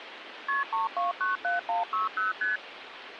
Multi-frequency trunk signalling (R1, as on North American trunks), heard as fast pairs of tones, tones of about 150 ms, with phone line noise. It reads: KP 3297160 ST